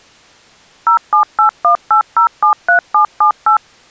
DTMF, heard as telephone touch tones, dialled by machine, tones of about 100 ms. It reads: 07818073778